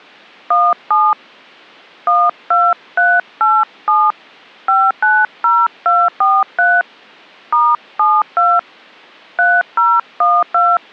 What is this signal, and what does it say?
DTMF, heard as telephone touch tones, dialled by hand, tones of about 220 ms. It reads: 17 12387 590243 *72 3012